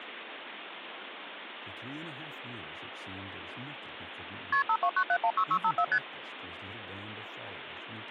Multi-frequency trunk signalling (R1, as on North American trunks), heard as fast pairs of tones, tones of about 70 ms, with phone line noise. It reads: KP 529716654 ST